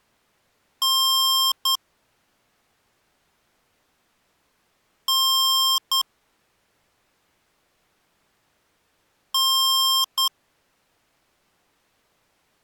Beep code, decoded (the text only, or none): 1 long, 1 short